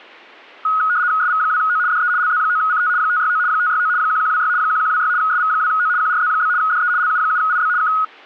RTTY (75 baud, 170 Hz shift), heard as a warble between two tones, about 1360 Hz centre. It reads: SV2O DE LZ9CT 569 569 1126 1126 SV2O QRZ? DE LU7IB K